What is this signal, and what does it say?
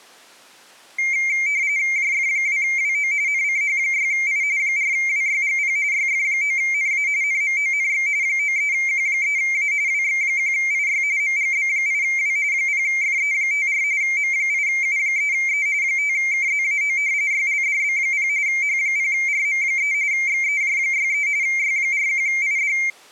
RTTY (45.45 baud, 170 Hz shift), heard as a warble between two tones, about 2200 Hz centre. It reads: JF2WO NCH6I 4WYGP YF9NA NMONX 93Q3A WX1IY MGB8W 0FE54 M8U3E 5KZAO YLDB0 H0RM3 XEJ63 Y41ID